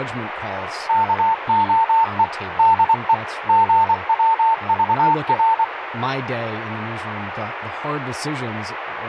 Morse code, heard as a keyed tone, machine-sent, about 24 wpm, 900 Hz, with radio static and speech in English. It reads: KOE DE GWVR